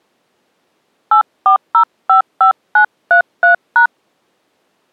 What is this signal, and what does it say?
DTMF, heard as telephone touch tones, dialled by hand, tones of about 100 ms. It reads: 84055933#